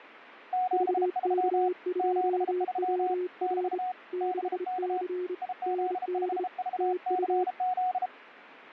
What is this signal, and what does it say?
Morse code, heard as two keyed tones, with radio static. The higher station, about 33 wpm, 740 Hz: 73 73 <BT> BK IZ5VCZ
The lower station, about 28 wpm, 360 Hz: VK2WR 6C ND TU